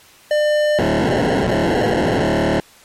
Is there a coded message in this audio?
Yes: POCSAG pager data (1200 baud) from 0.3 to 2.6 s, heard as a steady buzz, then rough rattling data.